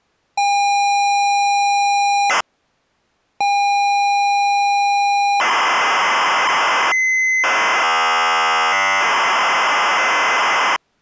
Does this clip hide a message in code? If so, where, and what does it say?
Yes: ZX Spectrum tape loading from 0.4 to 10.8 s, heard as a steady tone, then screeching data.